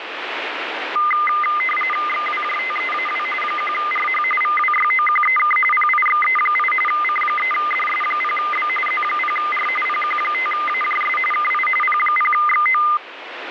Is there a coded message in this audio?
Yes: RTTY (45.45 baud, 850 Hz shift) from 1.0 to 13.0 s, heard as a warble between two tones, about 1650 Hz centre, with radio static. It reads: XWJTEAW 1RH VWYOQEK PIXE8 C3DS0B Z0R PQ5AJS KI P0XO